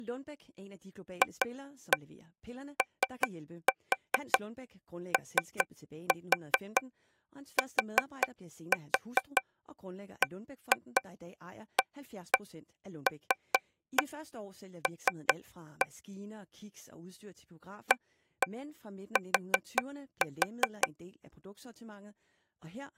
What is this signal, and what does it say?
Tap code, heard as taps on a table, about 5 knocks a second, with speech in English. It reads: FOOTBALL AT